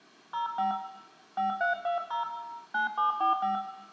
DTMF, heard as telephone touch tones, dialled by hand, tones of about 130 ms, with room echo. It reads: 05 5320 9745